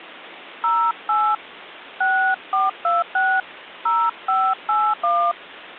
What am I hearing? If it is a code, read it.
DTMF, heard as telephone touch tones, dialled by hand, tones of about 260 ms. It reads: 08 6426 0581